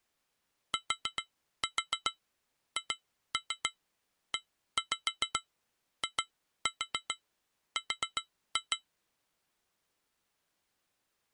Tap code, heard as taps on glass, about 7 knocks a second. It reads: THEIR